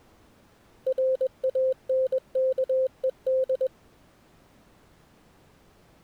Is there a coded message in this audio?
Yes: Morse code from 0.8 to 3.7 s, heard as a keyed tone, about 21 wpm, 520 Hz. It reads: RANKED